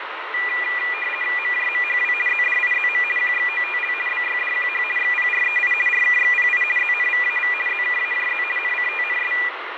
RTTY (50 baud, 450 Hz shift), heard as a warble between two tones, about 2200 Hz centre, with radio static and fading. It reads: MJMHW ZDIZM QXOTL BYDQH XPREI RKXPI ZNVAV ZKAJZ NCTNS